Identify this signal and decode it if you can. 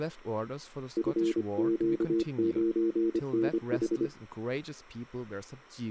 Morse code, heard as a keyed tone, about 25 wpm, 340 Hz, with speech in English. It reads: FQ9NH